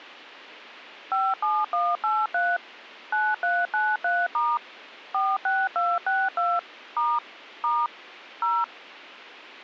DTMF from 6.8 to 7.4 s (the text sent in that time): *